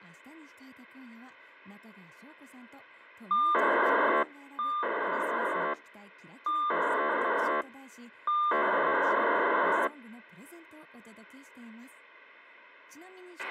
POCSAG pager data (2400 baud), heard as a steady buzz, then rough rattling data, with a squelch burst at the end and speech in Japanese.